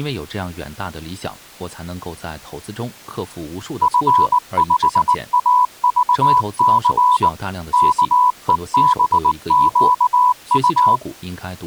Morse code, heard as a keyed tone, machine-sent, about 19 wpm, 990 Hz, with speech in Chinese. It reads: F5AVC KEBQU